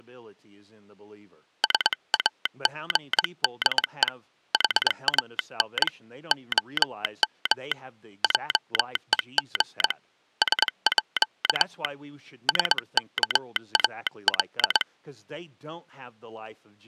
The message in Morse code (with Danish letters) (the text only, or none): SAGDE HAN OM JEG SÅ SKAL